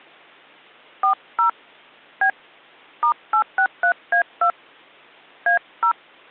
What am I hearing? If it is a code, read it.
DTMF, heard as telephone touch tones, dialled by hand, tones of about 100 ms. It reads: 40 B *863A2 A0